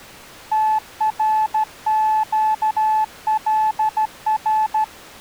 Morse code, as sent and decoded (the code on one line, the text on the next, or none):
- .-. --.- .-.. .-.
TRQLR